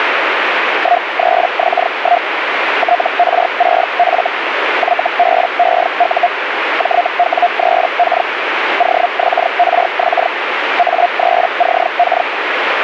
Hellschreiber (Feld-Hell, 122.5 baud), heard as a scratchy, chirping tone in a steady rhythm, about 700 Hz, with radio static. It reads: 13X1 TR6F YBEU JW3K OXRX A3CK